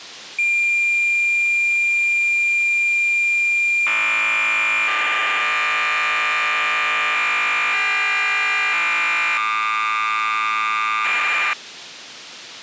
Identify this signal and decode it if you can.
Cassette data (Kansas City type), 1200 baud, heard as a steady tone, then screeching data.